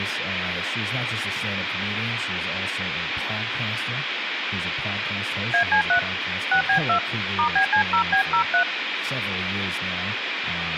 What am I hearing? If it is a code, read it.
DTMF, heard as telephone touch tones, dialled by hand, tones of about 100 ms, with phone line noise and speech in English. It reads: AC3 6B2 *BC0B03